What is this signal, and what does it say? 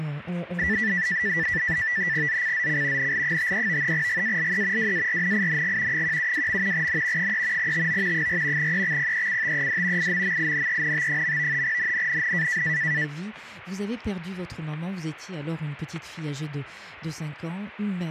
NAVTEX (SITOR-B), 100 baud, 170 Hz shift, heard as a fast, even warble, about 1850 Hz centre, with static crashes. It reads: ZCZC NL53 GALE WARNING 172. N 3 TO 4 EXPECTED IMMINENT. NNNN